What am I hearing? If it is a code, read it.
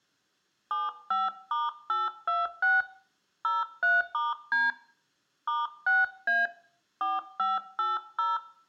DTMF, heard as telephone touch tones, dialled by hand, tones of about 180 ms, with room echo. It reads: 75*826 03*D *6A 4580